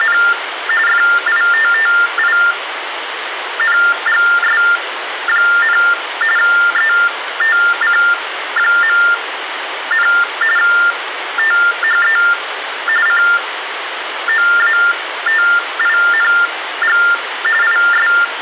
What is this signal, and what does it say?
TTY/TDD text telephone tones (45.45 baud Baudot), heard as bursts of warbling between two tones, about 400 Hz shift, 1600 Hz centre, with phone line noise. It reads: … FITTINGS, ETC., THE COATING IS